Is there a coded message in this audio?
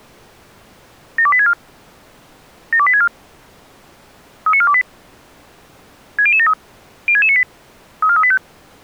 Yes: five-tone selective call (ZVEI) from 1.2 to 8.4 s, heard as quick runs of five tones, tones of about 70 ms. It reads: 72864 72864 39428 60073 06698 34385